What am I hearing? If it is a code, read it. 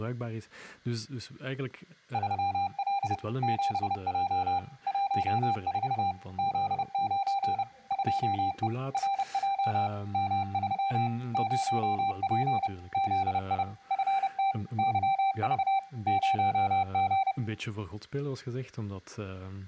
Morse code, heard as a keyed tone, machine-sent, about 30 wpm, 790 Hz, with room echo and speech in Dutch. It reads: 3L 7J 14 Z9 2E RJ M3 0P ZI FT YV 0G